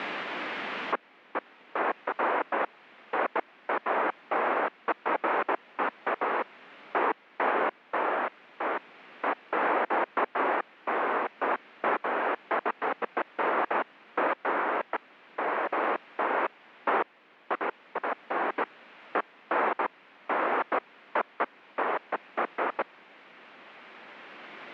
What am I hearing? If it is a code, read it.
Bursts of noise. There is no code.